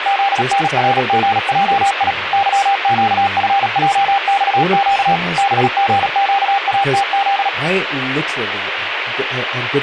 Morse code, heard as a keyed tone, machine-sent, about 37 wpm, 790 Hz, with radio static and speech in English. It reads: ZNRGJI YQFJXQ BGQATZ